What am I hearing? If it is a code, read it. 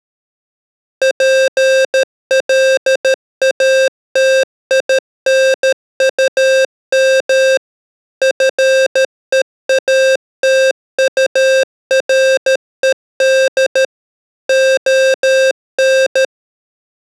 Morse code, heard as electronic beeps, machine-sent, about 13 wpm, 530 Hz. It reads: PLATINUM FEATURED ON